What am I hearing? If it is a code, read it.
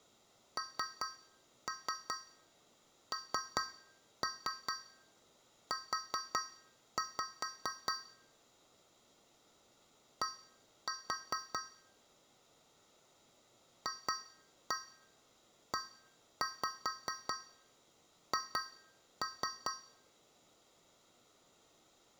Tap code, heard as taps on a metal pipe, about 4 knocks a second, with room echo. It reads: NNU D FEH